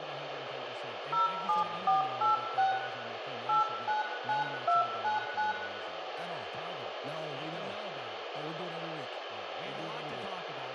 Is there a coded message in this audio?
Yes: DTMF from 1.1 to 5.5 s, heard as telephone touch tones, dialled by hand, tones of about 140 ms, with radio hiss, a squelch burst at the end and room echo. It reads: 07486 899299